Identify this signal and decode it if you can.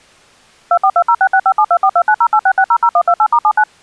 DTMF, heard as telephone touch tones, dialled by machine, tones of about 70 ms. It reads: 242066572429086600128*79